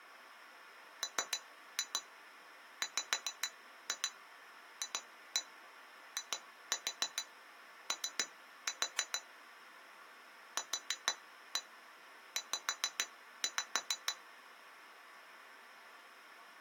Tap code, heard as taps on glass, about 6 knocks a second. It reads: MWFIO QZ